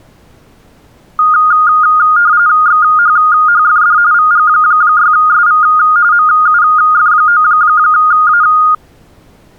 RTTY (45.45 baud, 170 Hz shift), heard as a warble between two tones, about 1330 Hz centre. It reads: XHHFD VG6SV MUF9A